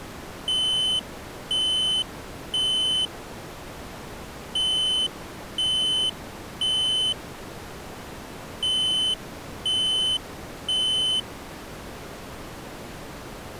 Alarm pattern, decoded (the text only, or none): temporal three